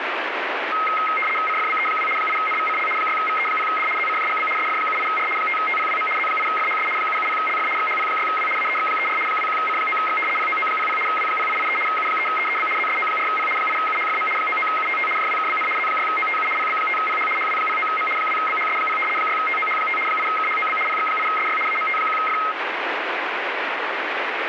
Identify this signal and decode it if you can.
RTTY (75 baud, 850 Hz shift), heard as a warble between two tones, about 1700 Hz centre, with radio static. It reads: CFBE2 8NVCL 6VE0D ZCJGB SF78R 5TPWM Z8FHS 770LF XHP6W AEX34 21C9X POO00 W0883 U3EEB ZSO4P 8UHFM 99UTT JWKBN Z6OTU PB5PH HW09M 2BHS0 6TOH5 8KHOB PX8SY AMT1F